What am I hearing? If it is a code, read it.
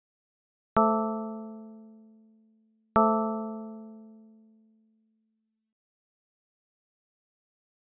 Clock strike, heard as a bell. 2. Two o'clock.